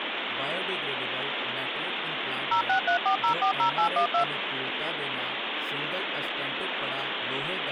DTMF, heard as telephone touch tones, dialled by machine, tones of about 100 ms, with phone line noise and speech in Punjabi. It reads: 0634040812